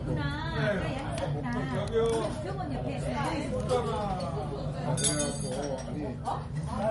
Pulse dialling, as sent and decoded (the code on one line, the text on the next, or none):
none